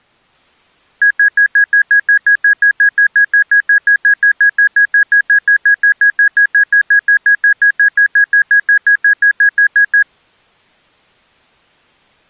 Evenly repeated beeps. There is no code.